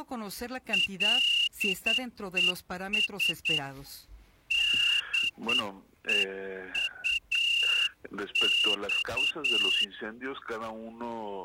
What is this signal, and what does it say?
Morse code, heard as a whistle, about 9 wpm. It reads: LES DEUX